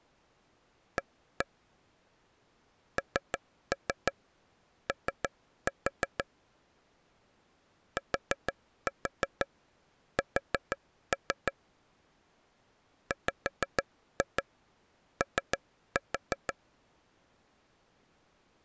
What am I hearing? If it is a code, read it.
Tap code, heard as taps on a table, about 6 knocks a second. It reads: A NO TS WO